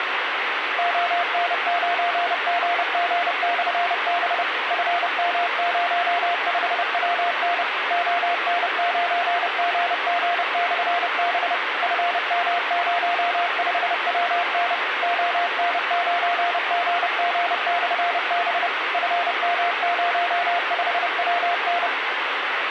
Morse code, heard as a keyed tone, machine-sent, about 30 wpm, 700 Hz, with radio hiss. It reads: ON9GG/B FM05WN ON9GG/B FM05WN ON9GG/B FM05WN